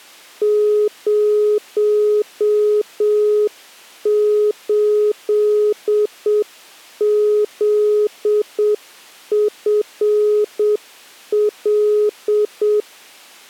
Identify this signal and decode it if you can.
Morse code, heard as a keyed tone, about 7 wpm, 420 Hz. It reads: 08ZFL